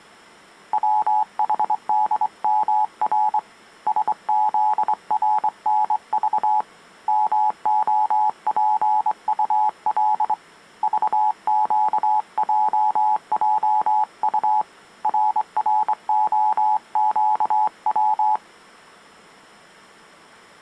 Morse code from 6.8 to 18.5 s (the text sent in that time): MOPUL VQJJU RROQW